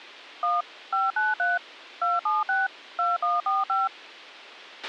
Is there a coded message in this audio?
Yes: DTMF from 0.4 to 3.9 s, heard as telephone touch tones, dialled by machine, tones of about 180 ms, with a squelch burst at the end. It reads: 1 593 276 2145